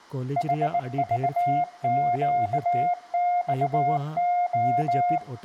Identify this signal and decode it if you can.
Morse code, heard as a keyed tone, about 19 wpm, 710 Hz, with room echo and speech in Santali. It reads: HVQXO